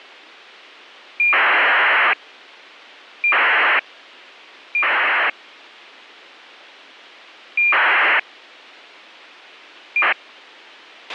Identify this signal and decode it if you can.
ACARS aircraft data, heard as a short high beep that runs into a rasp, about 2400 baud, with a squelch burst at the end.